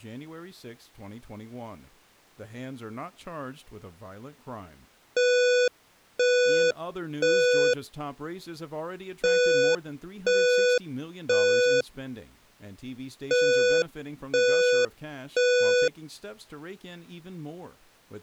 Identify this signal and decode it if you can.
Alarm pattern, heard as an alarm's beeps, played three times, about 490 Hz, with speech in English. Temporal three. Smoke or fire, evacuate.